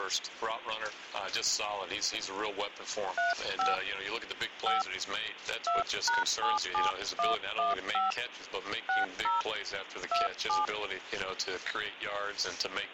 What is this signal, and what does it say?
DTMF, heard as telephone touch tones, dialled by hand, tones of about 160 ms. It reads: 35 5 2#77115 60 27